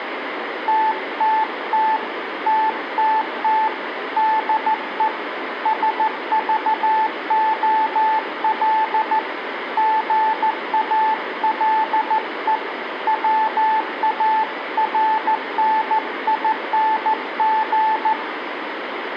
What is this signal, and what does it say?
Morse code, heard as a keyed tone, hand-sent with a paddle, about 14 wpm, 880 Hz, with radio static and room echo. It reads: TTT TTT DE SVOL GALE WARNING